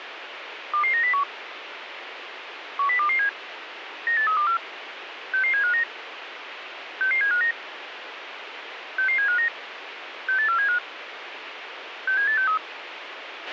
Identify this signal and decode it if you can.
Five-tone selective call (CCIR), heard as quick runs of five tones, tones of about 100 ms, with radio hiss and a squelch burst at the end. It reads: 22901 10227 98324 66759 66759 66759 68475 67863